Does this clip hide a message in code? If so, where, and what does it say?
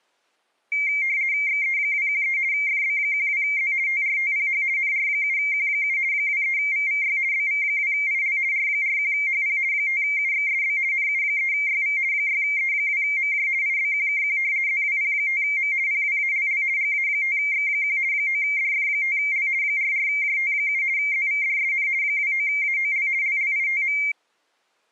Yes: RTTY (50 baud, 170 Hz shift) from 0.7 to 24.1 s, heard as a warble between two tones, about 2200 Hz centre. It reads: XE213 FB12Z TRTPH NR7Q7 23VVY BV2IL R41HP 5UXSB NU3YV 6E2MJ IBQKQ ZWP5M PWALL GA5X1 9DF5L 44JT7 ZVDSN 29AOL LLITM